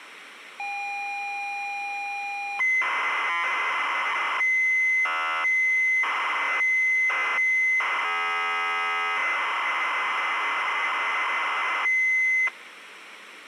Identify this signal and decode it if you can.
ZX Spectrum tape loading, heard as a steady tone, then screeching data, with tape hiss.